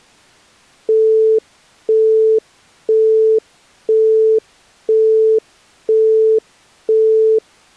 Telephone call progress tone (single-tone plan, as in Europe, Japan and elsewhere), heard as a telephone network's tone, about 440 Hz, 0.5 s on and 0.5 s off. Busy tone.